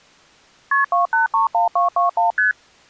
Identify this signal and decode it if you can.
Multi-frequency trunk signalling (R1, as on North American trunks), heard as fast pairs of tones, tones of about 130 ms. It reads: KP 2831221 ST